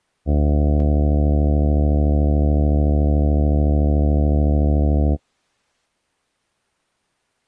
Ship horn signal, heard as a ship's horn, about 70 Hz. 1 long. At sea: a vessel nearing a blind bend, or under power and making way in fog.